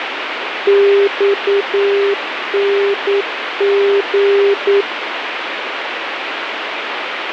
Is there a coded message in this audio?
Yes: Morse code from 0.6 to 4.9 s, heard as a keyed tone, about 9 wpm, 400 Hz, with radio static. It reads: XNG